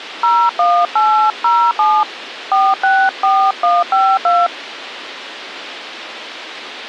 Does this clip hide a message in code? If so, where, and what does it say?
Yes: DTMF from 0.2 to 4.5 s, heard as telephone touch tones, dialled by hand, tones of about 260 ms. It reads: 01807 464152